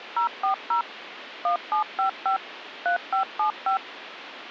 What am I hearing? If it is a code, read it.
DTMF, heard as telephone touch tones, dialled by machine, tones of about 110 ms, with phone line noise. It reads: 040 1755 3575